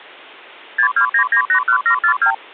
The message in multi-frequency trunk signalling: 629981742

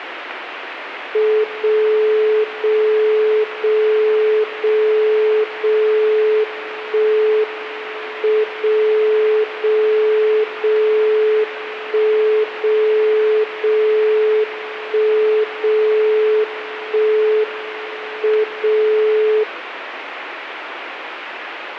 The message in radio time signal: 0 0 0 0 0 1 M 0 0 0 1 0 0 1 0 1 M 0

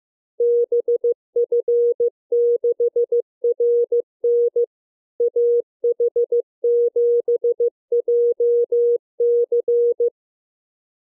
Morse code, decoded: BF6RN AH7JC

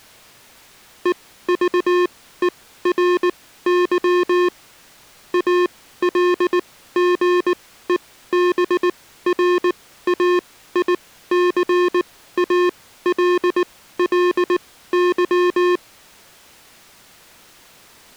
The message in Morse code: EVERY ALGEBRAICALLY

